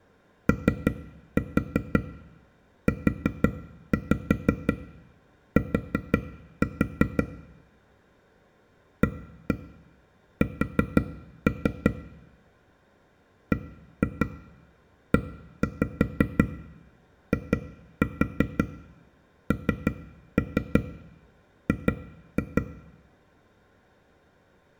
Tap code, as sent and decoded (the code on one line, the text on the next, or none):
3-4 4-5 4-4 / 1-1 4-3 / 1-2 1-5 2-4 3-3 2-2
OUT AS BEING